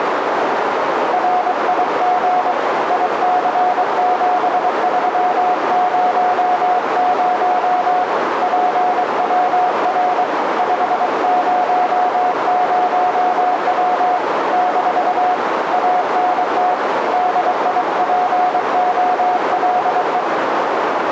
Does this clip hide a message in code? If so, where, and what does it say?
Yes: Morse code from 1.1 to 20.3 s, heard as a keyed tone, hand-sent with a paddle, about 23 wpm, 730 Hz, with heavy radio static and a narrow filter. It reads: RIG IC7300 PWR 500W - ANT DIPOLE